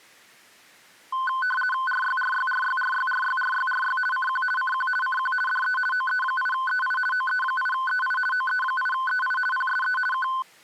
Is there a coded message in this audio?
Yes: RTTY (50 baud, 450 Hz shift) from 1.1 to 10.4 s, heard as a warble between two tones, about 1270 Hz centre. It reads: RYRYRYRYRYRYRY CQ CQ CQ DE OE8EI OE8EI OE8EI PSE K